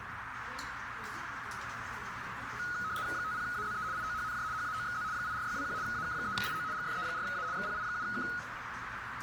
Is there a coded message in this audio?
Yes: RTTY (75 baud, 170 Hz shift) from 2.6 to 8.4 s, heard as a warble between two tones, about 1360 Hz centre, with radio static, a narrow filter and the noise of a restaurant. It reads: 50AZE IOHNJ HAOXZ 84621 AK3IO GFE4A XPI7K